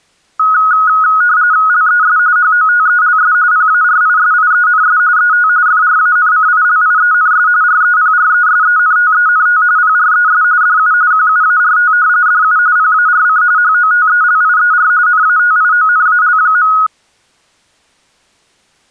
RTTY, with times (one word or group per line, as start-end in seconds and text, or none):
1.7-2.2 LES
2.4-3.3 HOTELS
3.5-5.0 PARISIENS
5.2-5.5 ET
5.7-7.5 FRANCILIENS
7.6-9.6 REPRESENTENT
9.8-10.4 PRES
10.6-10.9 DU
11.1-11.9 QUART
12.3-12.6 DU
12.8-13.4 PARC
13.6-14.9 HOTELIER
15.1-16.7 NATIONAL.